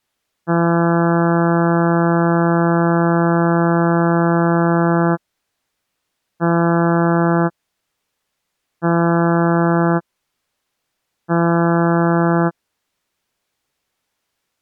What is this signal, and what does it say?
Ship horn signal, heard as a ship's horn, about 170 Hz. 1 long, 3 short. At sea: a vessel under tow in fog.